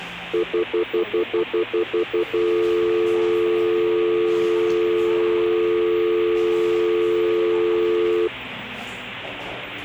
Telephone call progress tone (North American plan), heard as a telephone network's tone, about 350, 440 Hz, 0.1 s on and 0.1 s off, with the noise of a cafe. Stutter dial tone.